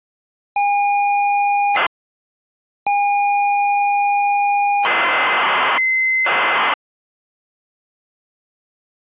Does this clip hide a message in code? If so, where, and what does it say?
Yes: ZX Spectrum tape loading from 0.6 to 6.7 s, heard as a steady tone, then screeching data.